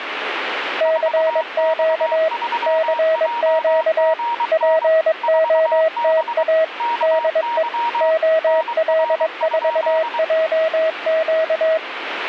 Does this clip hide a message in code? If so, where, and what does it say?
Yes: Morse code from 0.7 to 11.8 s, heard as two keyed tones, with radio static. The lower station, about 22 wpm, 640 Hz: CQ CQ POTA DE OL4JQ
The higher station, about 23 wpm, 940 Hz: 4X3JGN 4B KY NR?